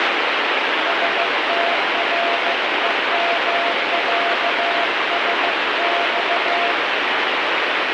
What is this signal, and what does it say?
Morse code (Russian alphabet), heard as a keyed tone, hand-sent with a paddle, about 15 wpm, 690 Hz, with heavy radio static. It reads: СТРЕМЯСЬ